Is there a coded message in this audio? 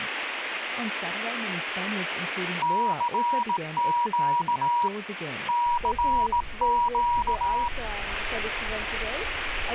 Yes: Morse code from 2.6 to 7.7 s, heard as a keyed tone, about 18 wpm, 960 Hz, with radio static. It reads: CQ CQ